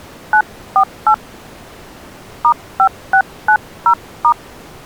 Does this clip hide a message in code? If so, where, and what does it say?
Yes: DTMF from 0.3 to 4.3 s, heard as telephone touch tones, dialled by hand, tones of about 80 ms. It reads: 948 *5690*